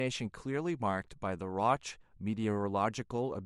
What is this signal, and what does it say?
Speech in English. There is no code.